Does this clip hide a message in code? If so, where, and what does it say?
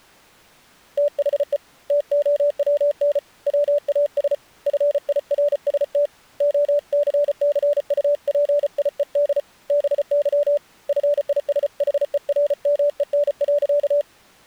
Yes: Morse code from 0.9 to 14.1 s, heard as a keyed tone, hand-sent with a paddle, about 34 wpm, 580 Hz. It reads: THE TOWN WAS FIRST OCCUPIED BY FISHERMEN.